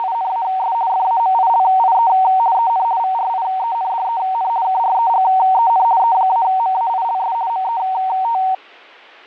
RTTY (50 baud, 170 Hz shift), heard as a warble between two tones, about 840 Hz centre. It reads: … FAMILIE EN VRIENDEN KREGEN E-MAILS MET